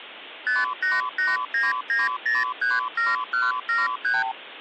Multi-frequency trunk signalling (R2, with the far end's replies), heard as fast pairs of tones, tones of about 180 ms. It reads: 58899037173